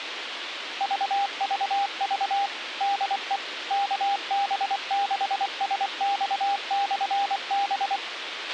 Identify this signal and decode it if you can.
Morse code, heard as a keyed tone, machine-sent, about 24 wpm, 800 Hz, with radio hiss and a squelch burst at the end. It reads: VVV DE KB6SX/B